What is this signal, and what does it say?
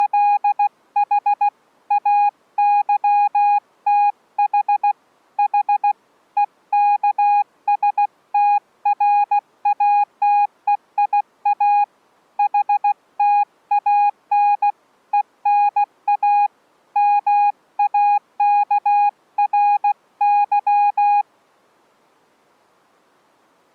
Morse code (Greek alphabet), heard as a keyed tone, hand-sent with a paddle, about 16 wpm, 820 Hz. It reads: … ΑΥΤΗ Η ΕΚΣΤΡΑΤΕΙΑ ΗΤΑΝ ΕΝΑ ΜΑΚΡΥ